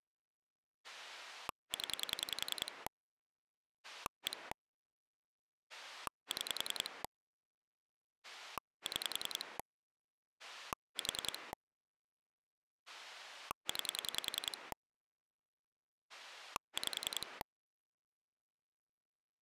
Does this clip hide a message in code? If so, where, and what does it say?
Yes: pulse dialling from 0.8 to 17.4 s, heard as a rotary dial, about 10 pulses a second. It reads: 0 1 6 6 4 9 5